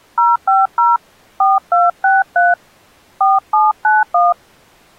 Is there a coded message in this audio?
Yes: DTMF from 0.2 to 4.3 s, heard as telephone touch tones, dialled by hand, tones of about 180 ms. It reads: 050 4263 4791